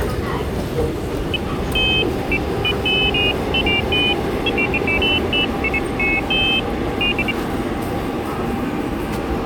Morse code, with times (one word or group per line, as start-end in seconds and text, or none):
none